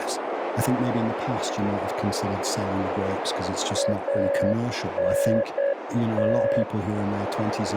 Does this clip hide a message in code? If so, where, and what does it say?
Yes: Morse code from 3.7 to 6.7 s, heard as a keyed tone, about 8 wpm, 560 Hz, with heavy radio static, a narrow filter and speech in English. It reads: ANT